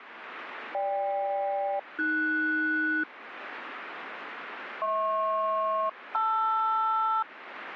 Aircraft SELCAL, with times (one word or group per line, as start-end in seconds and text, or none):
0.7-3.0 GK-AS
4.8-7.2 HP-LR